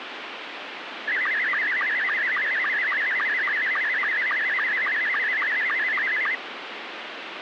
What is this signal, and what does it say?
SSTV (slow-scan television), Scottie S2, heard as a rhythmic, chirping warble, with radio static.